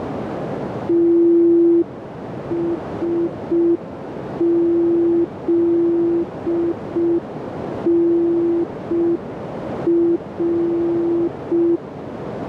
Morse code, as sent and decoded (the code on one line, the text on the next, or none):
- ... --.. -. .-.
TSZNR